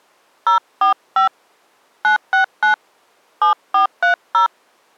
DTMF, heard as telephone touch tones, dialled by hand, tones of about 120 ms. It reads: 045 969 7430